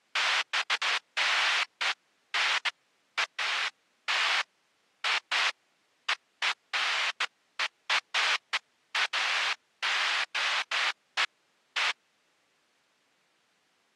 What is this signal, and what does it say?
Bursts of noise. There is no code.